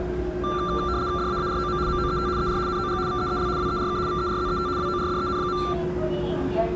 RTTY (75 baud, 170 Hz shift), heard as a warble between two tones, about 1270 Hz centre, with the noise inside a subway train. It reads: DAAROM MOET ER NOG VEEL WERK VERZET WORDEN.